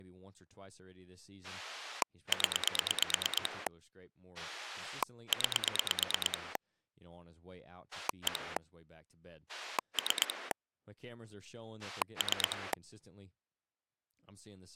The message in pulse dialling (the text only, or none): 0 9 1 3 3